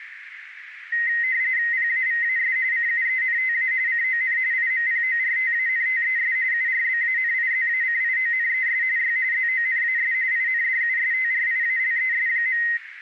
RTTY (45.45 baud, 170 Hz shift), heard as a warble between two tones, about 1950 Hz centre, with radio static and a narrow filter. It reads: PAVAS CUENTA CON IMPORTANTES URBANIZACIONES Y ZONAS INDUSTRIALES.